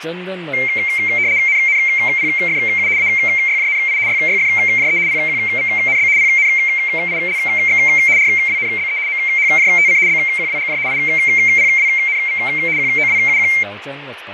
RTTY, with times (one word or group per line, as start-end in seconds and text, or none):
1.5-2.9 NNPFU
3.0-4.0 AYJNI
4.1-5.0 YYFJE
5.1-6.1 PQVNB
6.2-7.8 PNILX
8.2-9.0 RWNBE
9.1-10.0 MHJTC
10.1-10.8 BQWGJ
10.9-12.4 IPWNV
12.8-13.5 QOWUQ